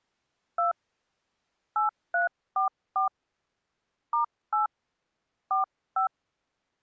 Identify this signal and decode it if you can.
DTMF, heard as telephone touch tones, dialled by hand, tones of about 120 ms. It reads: 2 8344 *8 45